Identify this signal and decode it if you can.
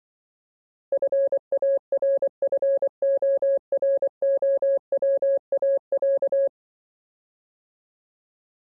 Morse code (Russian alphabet), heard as a keyed tone, machine-sent, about 24 wpm, 550 Hz. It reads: ФАРФОРОВАЯ